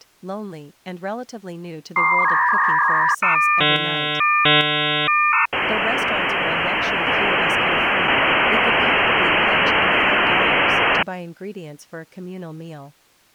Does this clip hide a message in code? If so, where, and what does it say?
Yes: dial-up modem handshake (V.34 or later) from 2.0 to 11.0 s, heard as a whistle, warbles, then hiss, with speech in English.